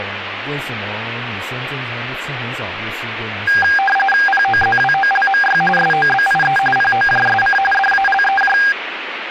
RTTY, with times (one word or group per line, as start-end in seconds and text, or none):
4.3-5.6 POZWOLMY
5.8-6.6 SOBIE
6.8-7.6 POJSC
7.7-8.6 DALEJ